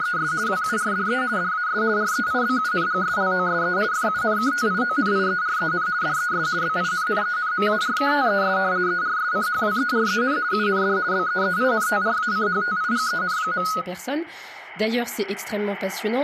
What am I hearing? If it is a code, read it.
RTTY (50 baud, 170 Hz shift), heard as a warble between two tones, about 1360 Hz centre, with speech in French. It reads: … WURDE DAS REIBUNGSLOSE FUNKTIONIEREN DES BINNENMARKTES ERSCHWEREN UND BEEINTRACHTIGEN.